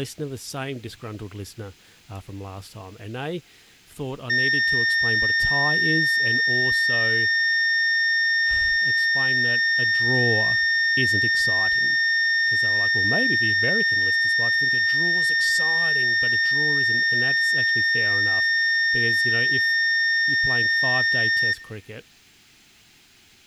A steady tone, with room echo and speech in English. There is no code.